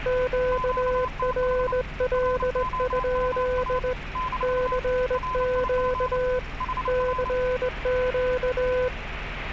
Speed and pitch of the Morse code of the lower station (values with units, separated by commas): 19 wpm, 500 Hz